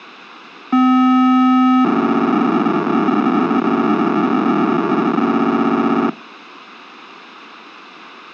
POCSAG pager data (512 baud), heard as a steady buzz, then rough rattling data, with radio hiss.